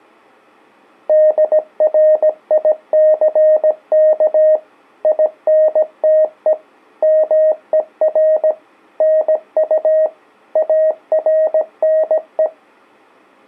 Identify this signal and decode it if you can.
Morse code, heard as a keyed tone, machine-sent, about 17 wpm, 620 Hz. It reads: DRICK INTE MER NU ARNE